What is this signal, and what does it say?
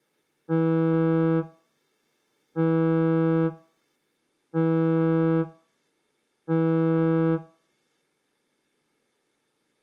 Ship horn signal, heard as a ship's horn, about 160 Hz, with room echo. 4 short. At sea: a pilot vessel's identity signal in fog.